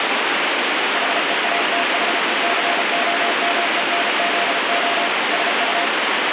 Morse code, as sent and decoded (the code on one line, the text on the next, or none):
.... . .- - .... / -.-. --- -- . -. --.. --- / ... ..-
HEATH COMENZO SU